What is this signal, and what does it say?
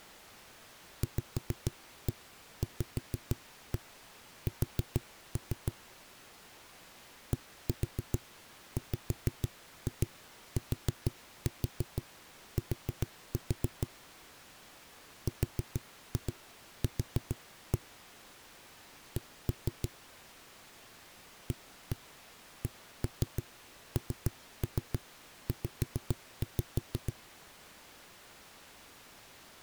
Tap code, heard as knocks on a wall, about 6 knocks a second. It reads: VVS DWTT RQ C ACNZ